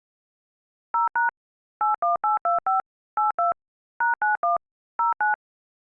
DTMF, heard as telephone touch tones, dialled by machine, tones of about 140 ms. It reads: 0# 81825 82 #91 09